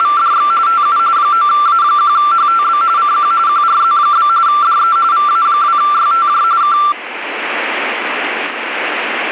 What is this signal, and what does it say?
RTTY (45.45 baud, 170 Hz shift), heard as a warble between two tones, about 1260 Hz centre, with radio static. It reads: … TU 9A1HTB CQ QRZ? DE VA2YTJ K